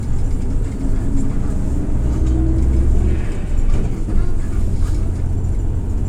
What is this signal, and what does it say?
The noise inside a bus. There is no code.